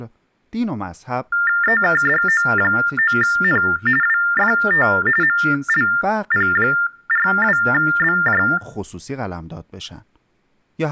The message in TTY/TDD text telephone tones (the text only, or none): EKDO9N WFT MLP42BJ